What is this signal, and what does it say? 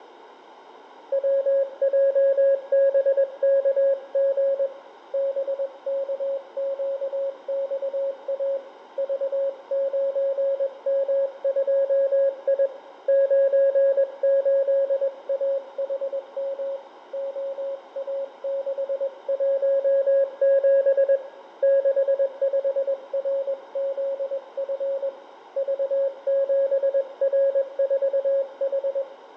Morse code, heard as a keyed tone, hand-sent with a paddle, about 21 wpm, 550 Hz, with radio static, fading and room echo. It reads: WJBKG BKQXA V9M2I 98AHM OA617 65RZF V7R4H